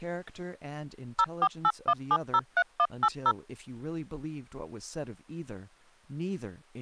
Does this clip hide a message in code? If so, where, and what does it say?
Yes: DTMF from 1.2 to 3.3 s, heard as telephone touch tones, dialled by machine, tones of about 60 ms, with speech in English. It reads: 0481703180